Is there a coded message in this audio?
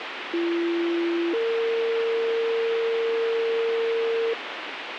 Yes: two-tone page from 0.3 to 4.3 s, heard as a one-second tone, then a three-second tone, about 340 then 460 Hz, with radio hiss.